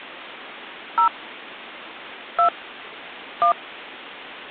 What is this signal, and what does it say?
DTMF, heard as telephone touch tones, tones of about 100 ms. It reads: 0 2 1